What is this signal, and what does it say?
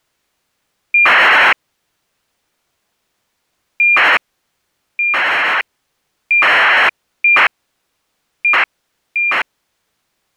ACARS aircraft data, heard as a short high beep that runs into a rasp, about 2400 baud.